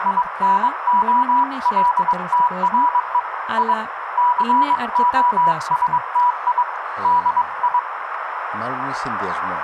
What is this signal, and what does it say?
Morse code, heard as a keyed tone, hand-sent with a paddle, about 22 wpm, 980 Hz, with radio static, a narrow filter, room echo and speech in Greek. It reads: INOLTRE I COSTI DI